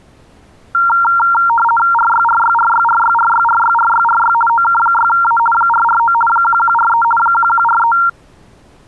RTTY (50 baud, 450 Hz shift), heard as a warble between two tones, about 1150 Hz centre. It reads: RYRYRYRYRYRYRYRY OK6A 449 1143 1143